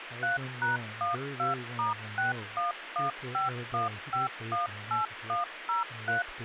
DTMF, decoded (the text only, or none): 3#12*61151518103